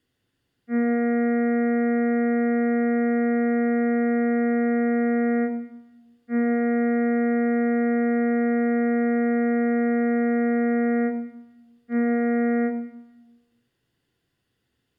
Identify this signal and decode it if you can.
Ship horn signal, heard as a ship's horn, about 240 Hz, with room echo. 2 long, 1 short. At sea: I intend to overtake on your starboard side.